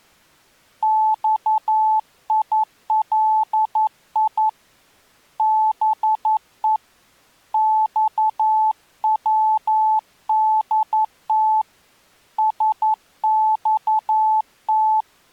Morse code (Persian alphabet), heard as a keyed tone, hand-sent with a paddle, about 11 wpm, 870 Hz. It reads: خیلی به خودت سخت